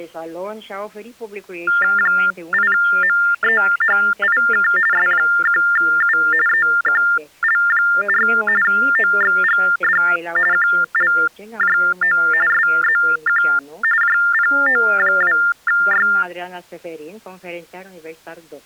TTY/TDD text telephone tones (45.45 baud Baudot), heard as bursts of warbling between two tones, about 400 Hz shift, 1600 Hz centre. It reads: 8MEHIK S1U EQL4 OXGD QLJO SZQ JPO2Y